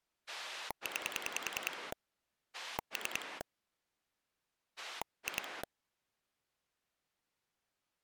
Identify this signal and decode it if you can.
Pulse dialling, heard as a rotary dial, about 10 pulses a second. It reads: 9 3 2